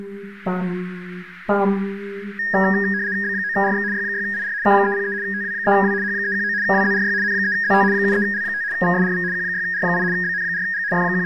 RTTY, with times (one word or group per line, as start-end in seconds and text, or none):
3.2-3.8 B9RX
3.9-4.5 Y6IR
4.6-5.1 K303
5.2-5.9 TW3W
6.0-6.5 H319
6.6-7.1 WZRY
7.2-7.8 N3ZT
7.9-8.6 73L5
8.7-9.2 VSRV
9.3-10.0 Q6R8
10.1-10.8 BN4G
10.9-11.3 …